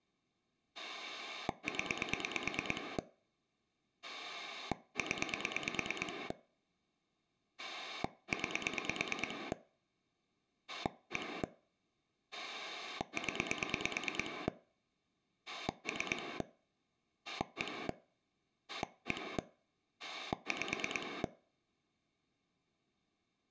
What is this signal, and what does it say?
Pulse dialling, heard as a rotary dial, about 9 pulses a second. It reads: 0 0 9 1 0 3 1 1 5